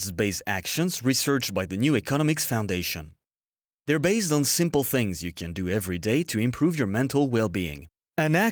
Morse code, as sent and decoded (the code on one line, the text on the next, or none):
none